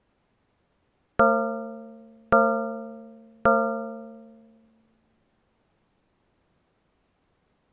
Clock strike, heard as a bell. 3. Three o'clock.